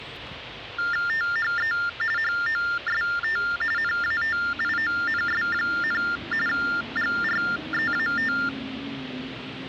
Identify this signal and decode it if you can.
TTY/TDD text telephone tones (45.45 baud Baudot), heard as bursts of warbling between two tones, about 400 Hz shift, 1600 Hz centre, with phone line noise and street noise. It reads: THE HOST NATIONS, GREAT